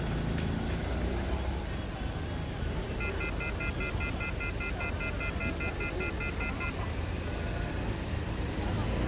Telephone call progress tone (North American plan), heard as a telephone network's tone, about 1400, 2050, 2450, 2600 Hz, 0.1 s on and 0.1 s off, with street noise. Off-hook warning tone.